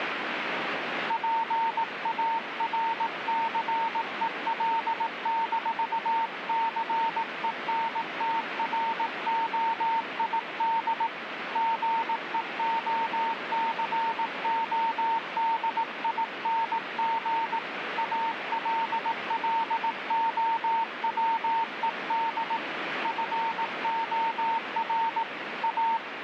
Morse code, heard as a keyed tone, hand-sent with a paddle, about 18 wpm, 910 Hz, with radio static. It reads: PARCEL-CENTROID GEOCODING ALLOWED FOR A